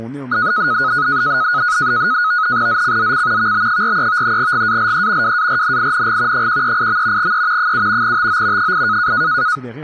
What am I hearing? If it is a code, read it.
NAVTEX (SITOR-B), 100 baud, 170 Hz shift, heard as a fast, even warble, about 1360 Hz centre, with static crashes and speech in French. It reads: ZCZC VB43 GALE WARNING 138. E 7 TO 8